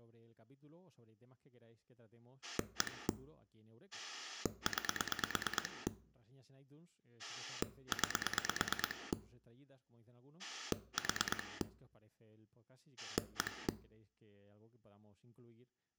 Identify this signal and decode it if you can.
Pulse dialling, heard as a rotary dial, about 9 pulses a second, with speech in Spanish. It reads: 1 9 9 4 1